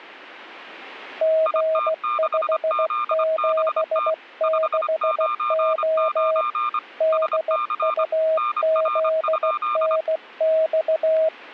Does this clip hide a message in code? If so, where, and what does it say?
Yes: Morse code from 1.2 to 11.3 s, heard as two keyed tones. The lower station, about 16 wpm, 640 Hz: G576O DUZNX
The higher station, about 25 wpm, 1200 Hz: IT6ZBT 599 SC NR?